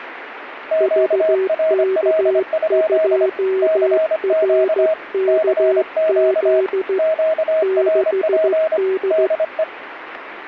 Morse code, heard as two keyed tones, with radio static. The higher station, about 25 wpm, 640 Hz: QRL? CQ CQ QRP DE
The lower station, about 15 wpm, 380 Hz: VK2RKZ 6D